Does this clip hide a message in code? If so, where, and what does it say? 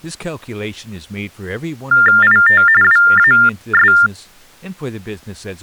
Yes: TTY/TDD text telephone tones (45.45 baud Baudot) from 1.9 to 4.1 s, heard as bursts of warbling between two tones, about 400 Hz shift, 1600 Hz centre, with speech in English. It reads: IT WAS